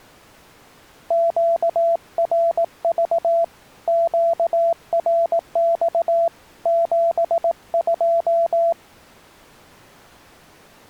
Morse code, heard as a keyed tone, hand-sent with a paddle, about 18 wpm, 670 Hz. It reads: QRV QRX 72